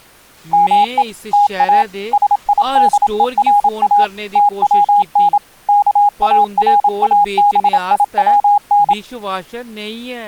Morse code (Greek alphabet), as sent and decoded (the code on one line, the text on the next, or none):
-- . / - .- / ... .. -.. . .-. .- / - .-- -. / -.- .- .-. .- -... .. .-- -.
ΜΕ ΤΑ ΣΙΔΕΡΑ ΤΩΝ ΚΑΡΑΒΙΩΝ